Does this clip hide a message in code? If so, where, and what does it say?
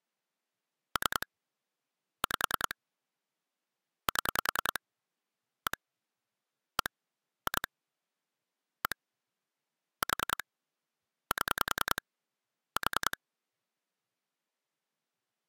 Yes: pulse dialling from 1.0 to 13.1 s, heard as clicks on a phone line, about 10 pulses a second. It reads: 3 5 7 1 1 2 1 4 7 4